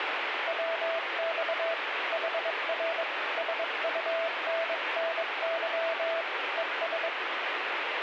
Morse code, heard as a keyed tone, hand-sent with a bug key, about 22 wpm, 660 Hz, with heavy radio static. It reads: WX HR SUNNY ES